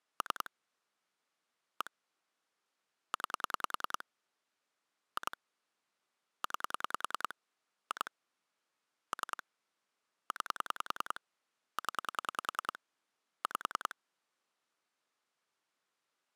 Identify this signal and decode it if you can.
Pulse dialling, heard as clicks on a phone line, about 10 pulses a second. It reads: 3 1 9 2 9 2 3 9 0 5